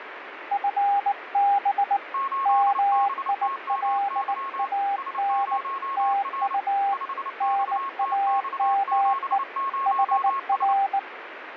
Morse code, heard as two keyed tones, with radio static. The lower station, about 19 wpm, 800 Hz: FB MILAN TU NAME HR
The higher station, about 29 wpm, 1090 Hz: 8BTMY S0R 5XTX70S